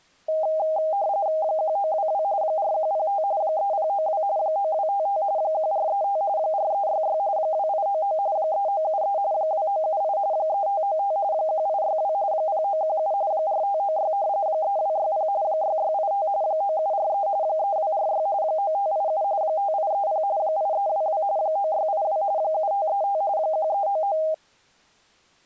RTTY (45.45 baud, 170 Hz shift), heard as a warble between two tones, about 720 Hz centre. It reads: 1922 4105 3092 9255 1435 4366 2899 3973 2978 3595 1862 0917 4596 3260 6685 9743 3246 9587 5830 8322 9682 7535 1399